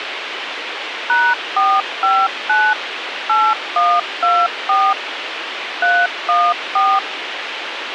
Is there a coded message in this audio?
Yes: DTMF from 1.1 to 7.0 s, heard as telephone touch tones, dialled by machine, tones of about 240 ms, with radio hiss. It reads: #459 8124 314